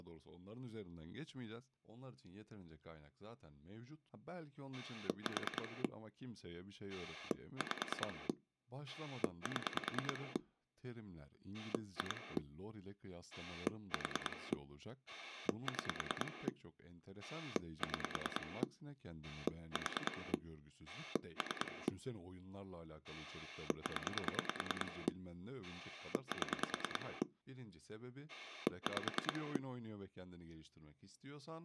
Pulse dialling, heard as a rotary dial, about 9 pulses a second, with speech in Turkish. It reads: 4 5 7 2 4 6 6 4 3 0 7 5